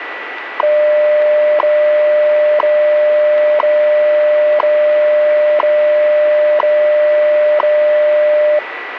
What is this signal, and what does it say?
Radio time signal (WWV, Colorado), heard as ticks, one a second, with radio static and a steady whistle near 1960 Hz.